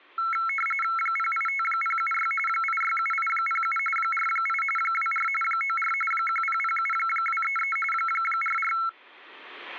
RTTY (45.45 baud, 850 Hz shift), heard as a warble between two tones, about 1750 Hz centre. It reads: 085076 867807 48 24 94 1007233 44